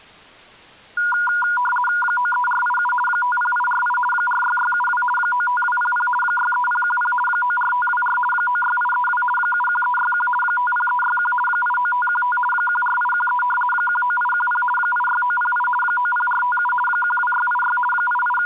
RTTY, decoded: 93487 50848 46672 95200 63010 94524 96832 71361 50361 89515 14813 19810 86908 90457 12686 …

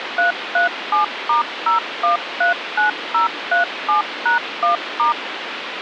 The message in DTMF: 337*0139037#1*

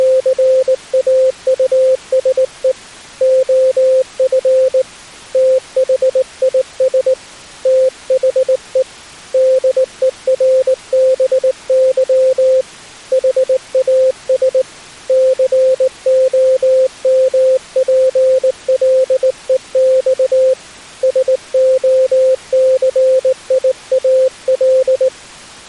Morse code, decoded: … OF THIS THE DERBY HAS COMPLEX SOCIAL

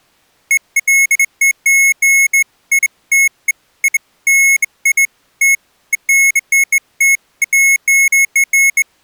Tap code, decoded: none

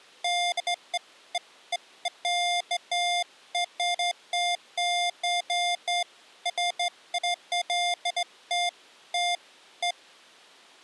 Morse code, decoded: none

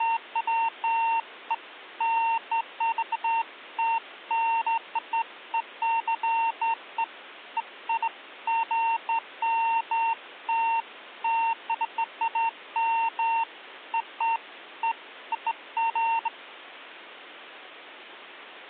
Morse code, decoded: none

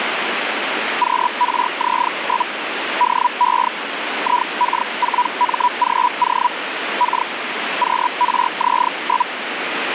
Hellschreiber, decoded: QRZ? DE IK4MGO K QRZ?

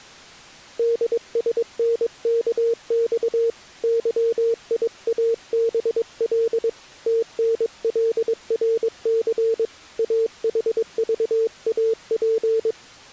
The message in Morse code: DSNKX YIABL TNLRC AHVAP

